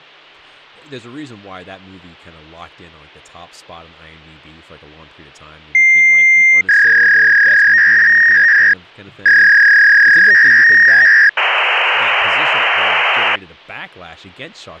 Fax machine handshake, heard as a long tone, a warble and hiss, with hum and speech in English.